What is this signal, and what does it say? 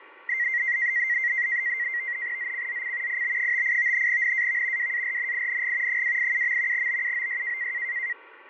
NAVTEX (SITOR-B), 100 baud, 170 Hz shift, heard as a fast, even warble, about 2000 Hz centre, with radio static, fading and a steady whistle near 1140 Hz. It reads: ZCZC IB58 NAV WARNING 287. BUOY